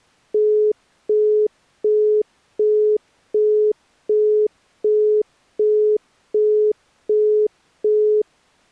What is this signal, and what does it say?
Telephone call progress tone (as in the UK, Australia and similar networks), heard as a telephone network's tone, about 420 Hz, 0.375 s on and 0.375 s off. Busy tone.